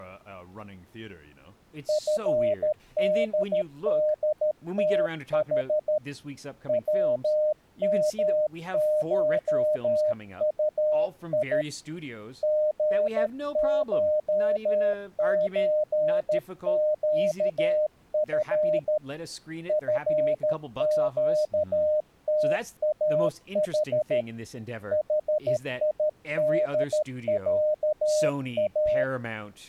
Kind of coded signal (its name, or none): Morse code